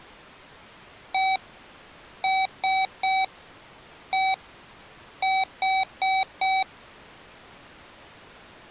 Beep code, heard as beeps from a small speaker, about 760 Hz. 1-3-1-4.